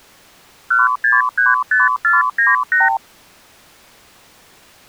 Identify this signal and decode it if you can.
Multi-frequency trunk signalling (R2, with the far end's replies), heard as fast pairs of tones, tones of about 170 ms. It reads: 1635498